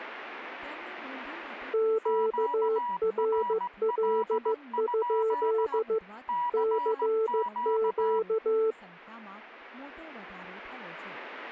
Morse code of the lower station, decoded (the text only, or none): QRL? CQ